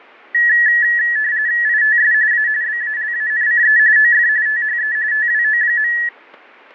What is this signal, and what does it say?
RTTY (45.45 baud, 170 Hz shift), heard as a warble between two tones, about 1800 Hz centre, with fading. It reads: ITS A BALANCE OF THE TWO.